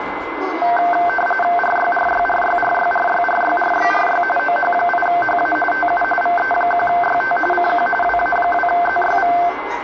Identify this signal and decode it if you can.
RTTY (45.45 baud, 850 Hz shift), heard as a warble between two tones, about 1120 Hz centre, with radio static, a steady whistle near 2050 Hz and the noise inside a lift. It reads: RYRYRYRYRYRYRYRY OH8HA TU VE1YT CQ WA2ZYV